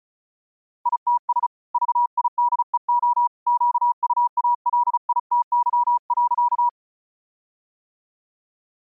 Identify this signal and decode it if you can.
Morse code, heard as a keyed tone, hand-sent with a paddle, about 35 wpm, 960 Hz. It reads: ITS VIDEO QUALITY.